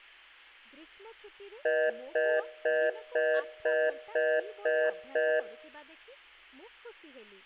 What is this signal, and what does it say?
Telephone call progress tone (North American plan), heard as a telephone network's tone, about 480, 620 Hz, 0.25 s on and 0.25 s off, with room echo and speech in Odia. Congestion tone.